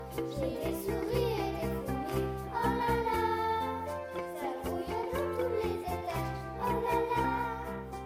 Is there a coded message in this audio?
No.